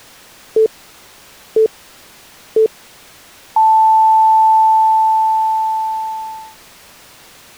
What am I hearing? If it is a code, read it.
Radio time signal (three low pips and a long one an octave up, as on NHK), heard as pips.